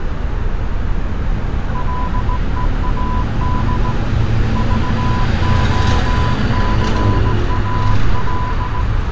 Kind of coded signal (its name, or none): Morse code